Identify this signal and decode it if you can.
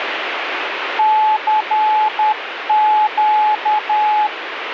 Morse code, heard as a keyed tone, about 10 wpm, 860 Hz, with radio static. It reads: CQ